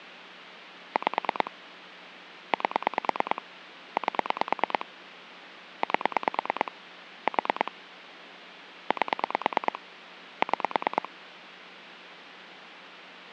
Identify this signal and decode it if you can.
Pulse dialling, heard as clicks on a phone line, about 9 pulses a second. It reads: 5 8 8 8 4 8 6